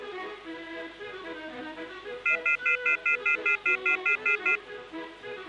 Telephone call progress tone (North American plan), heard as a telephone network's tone, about 1400, 2050, 2450, 2600 Hz, 0.1 s on and 0.1 s off, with hum. Off-hook warning tone.